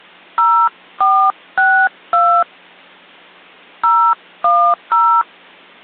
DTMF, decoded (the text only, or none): 0462 010